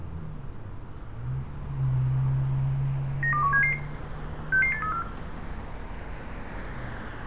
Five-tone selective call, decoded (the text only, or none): 92177 66834